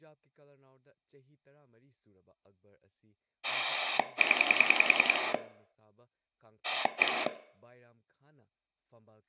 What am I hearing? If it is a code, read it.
Pulse dialling, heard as a rotary dial, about 10 pulses a second, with room echo and speech in Manipuri. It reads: 0 1